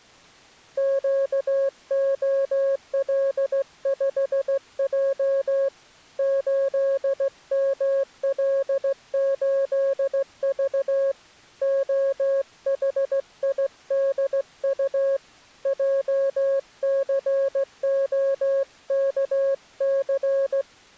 Morse code, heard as a keyed tone, hand-sent with a straight key, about 16 wpm, 550 Hz. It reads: QOL5J 8ML8V OHIDU JCOKC